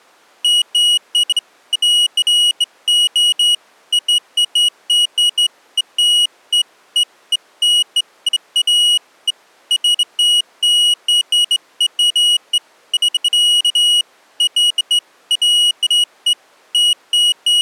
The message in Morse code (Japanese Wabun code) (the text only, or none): none